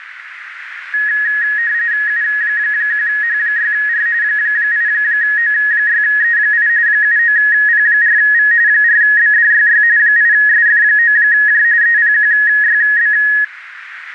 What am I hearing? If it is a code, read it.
RTTY (45.45 baud, 170 Hz shift), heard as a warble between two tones, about 1800 Hz centre, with radio static and a narrow filter. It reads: U1H6R 8O6E8 79P4V 4BDYY 8SF9J EPQYB